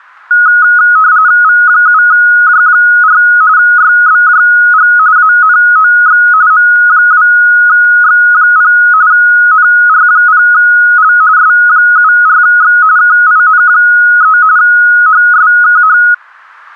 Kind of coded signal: RTTY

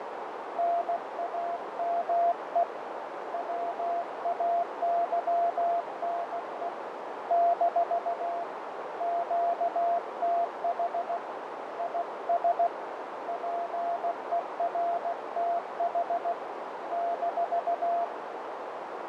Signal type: Morse code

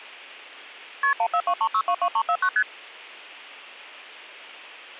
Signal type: multi-frequency trunk signalling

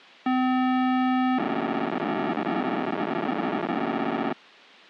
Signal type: POCSAG pager data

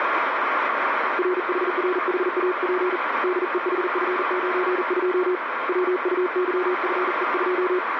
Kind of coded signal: Morse code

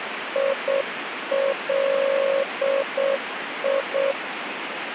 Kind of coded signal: Morse code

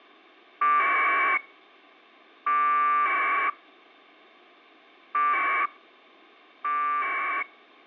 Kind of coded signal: packet radio (AX.25, as in APRS)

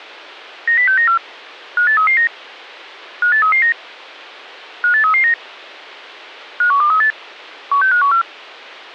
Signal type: five-tone selective call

